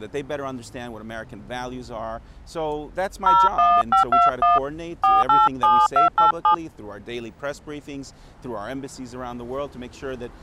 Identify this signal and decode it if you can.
DTMF, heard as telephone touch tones, dialled by hand, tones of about 170 ms. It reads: 01521 487287